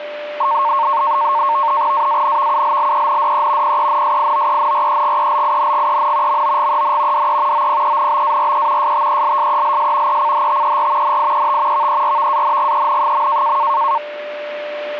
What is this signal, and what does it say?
NAVTEX (SITOR-B), 100 baud, 170 Hz shift, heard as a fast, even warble, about 1000 Hz centre, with a steady whistle near 590 Hz. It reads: AANVULLENDE PENSIOENREGELINGEN MOGEN DE OPENBARE STELSELS ECHTER NIET VERVANGEN.